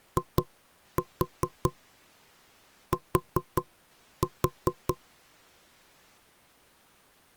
Tap code, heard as knocks on wood, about 4 knocks a second. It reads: IT